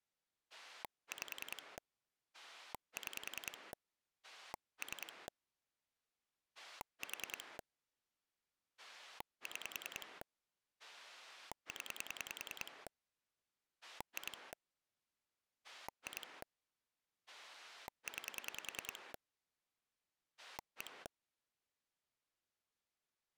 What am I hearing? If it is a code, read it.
Pulse dialling, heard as a rotary dial, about 10 pulses a second. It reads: 5 6 3 4 6 0 2 2 9 1